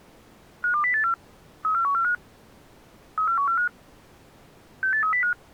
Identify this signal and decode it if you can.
Five-tone selective call (CCIR), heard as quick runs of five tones, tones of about 100 ms. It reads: 52084 34145 34145 68305